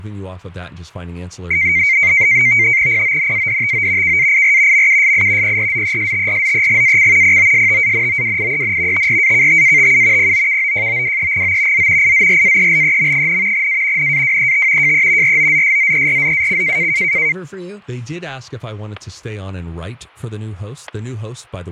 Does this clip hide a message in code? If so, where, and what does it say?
Yes: NAVTEX (SITOR-B), 100 baud, 170 Hz shift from 1.5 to 17.3 s, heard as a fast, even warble, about 2200 Hz centre, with fading, static crashes and speech in English. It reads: PONADTO KAIR MUSI PRZESTRZEGAC POSTANOWIEN TRAKTATU POKOJOWEGO Z IZRAELEM, A NAWET JE ROZSZERZAC